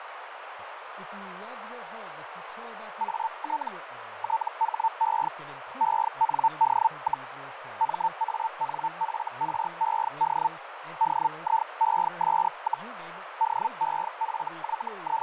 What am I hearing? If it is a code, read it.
Hellschreiber (Feld-Hell, 122.5 baud), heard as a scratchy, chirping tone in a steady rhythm, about 900 Hz, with radio static, a narrow filter and speech in English. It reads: AT THE END, MANFRED DIES, …